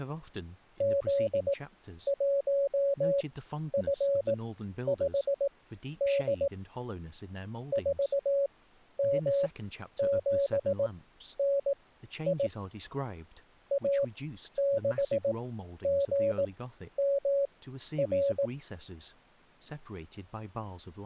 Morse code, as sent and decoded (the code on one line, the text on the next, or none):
--.. .---- ..-. ..... -.. / ....- -- --... -. .. / .- -.... --. -- .-.
Z1F5D 4M7NI A6GMR